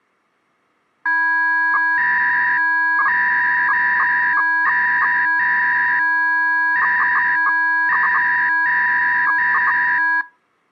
300-baud modem data (V.21 tones), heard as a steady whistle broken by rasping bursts, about 300 baud, 200 Hz shift.